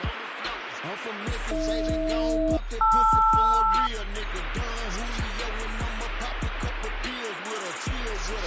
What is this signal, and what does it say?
Aircraft SELCAL, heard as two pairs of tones, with radio static. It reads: AH-LR